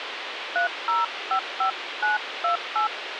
DTMF, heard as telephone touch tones, dialled by hand, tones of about 130 ms, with radio hiss. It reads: 3055928